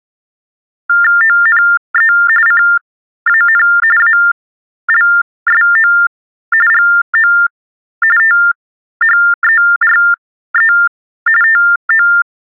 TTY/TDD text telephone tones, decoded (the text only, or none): ONE CAN ALSO GO THERE TO